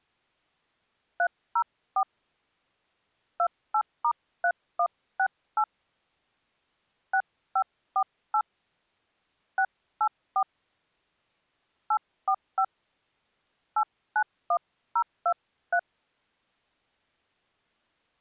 DTMF, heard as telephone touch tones, dialled by hand, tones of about 70 ms. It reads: 304 28*3168 6548 684 845 891023